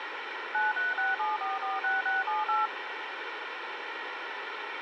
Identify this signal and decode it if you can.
DTMF, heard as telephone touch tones, dialled by machine, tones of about 170 ms, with radio hiss. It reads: 9367446678